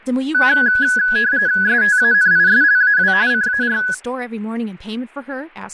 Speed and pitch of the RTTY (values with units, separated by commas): 45.45 baud, 170 Hz shift, 1600 Hz centre